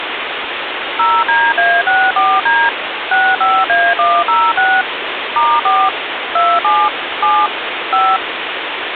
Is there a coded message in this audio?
Yes: DTMF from 1.0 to 8.2 s, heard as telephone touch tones, dialled by machine, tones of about 240 ms, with phone line noise. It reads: 0DA64D 65A106 *4 27 7 5